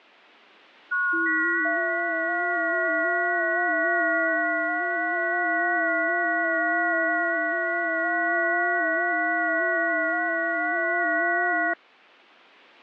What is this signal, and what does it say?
FT8 (several signals at once), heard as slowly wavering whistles, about 6.25 baud.